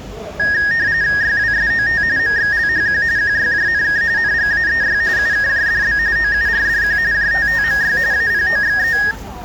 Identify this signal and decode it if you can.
RTTY (45.45 baud, 170 Hz shift), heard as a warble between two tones, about 1750 Hz centre, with the noise of a residential street. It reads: YWSOT MXLHQ QYJNK NGAEY UKJDB OURDQ JTTMY APOXE